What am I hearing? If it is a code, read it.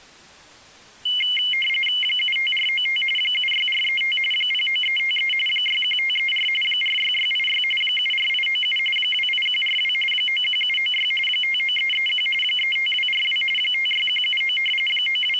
RTTY (45.45 baud, 850 Hz shift), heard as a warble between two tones, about 2550 Hz centre. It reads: 75495 76435 09353 61534 46686 74897 28142 91796 59331 35242 56179 …